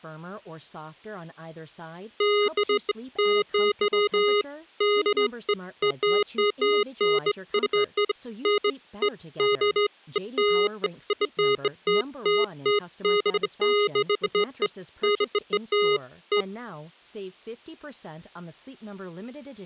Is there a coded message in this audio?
No, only beeps of irregular length, with speech in English.